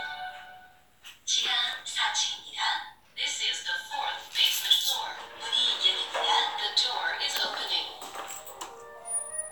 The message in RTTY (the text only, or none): none